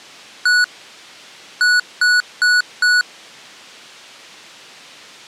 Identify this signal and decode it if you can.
Beep code, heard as beeps from a small speaker, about 1470 Hz. 1-4.